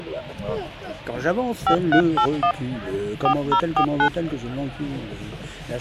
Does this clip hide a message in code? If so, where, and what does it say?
Yes: DTMF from 1.7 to 4.1 s, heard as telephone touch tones, dialled by hand, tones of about 80 ms. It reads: 5381 4049